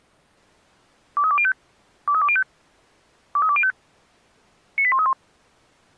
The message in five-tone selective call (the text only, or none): 23205 23205 23205 98131